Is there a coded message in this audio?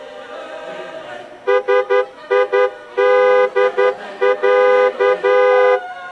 Yes: Morse code (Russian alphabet) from 1.4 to 5.8 s, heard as a horn, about 11 wpm. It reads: СИДЯ